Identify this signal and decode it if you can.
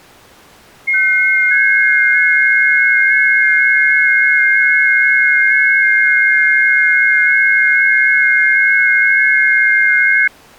FT8 (several signals at once), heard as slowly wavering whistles, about 6.25 baud.